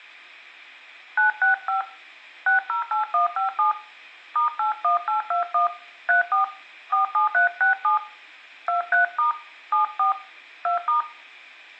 DTMF, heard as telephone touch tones, dialled by hand, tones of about 130 ms, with room echo. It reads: 965 608157 *81821 34 47367 23* 74 2*